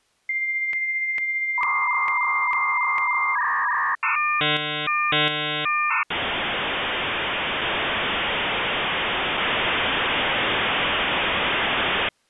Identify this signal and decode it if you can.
Dial-up modem handshake (V.34 or later), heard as a whistle, warbles, then hiss.